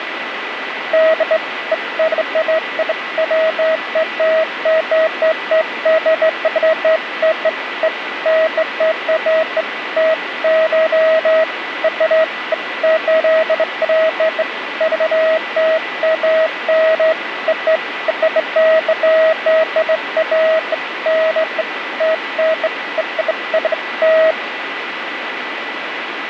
Beeps of irregular length, with radio static and a steady whistle near 1980 Hz. There is no code.